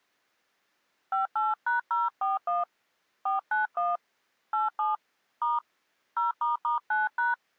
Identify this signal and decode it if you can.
DTMF, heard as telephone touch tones, dialled by hand, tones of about 160 ms. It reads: 58#041 491 87 * 0**9#